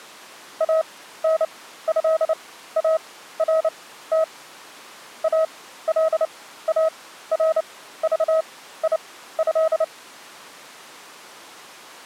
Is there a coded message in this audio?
Yes: Morse code (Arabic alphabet) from 0.5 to 9.9 s, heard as a keyed tone, machine-sent, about 29 wpm, spaced as for 15 wpm, 640 Hz. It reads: انهارت الارضيه